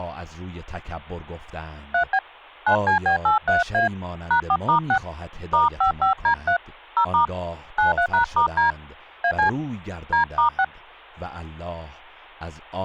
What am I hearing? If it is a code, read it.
DTMF, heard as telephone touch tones, dialled by hand, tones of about 100 ms, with speech in Persian. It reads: 3B 9CB83A #4*6 *55D3 0* 93#*D AC D*6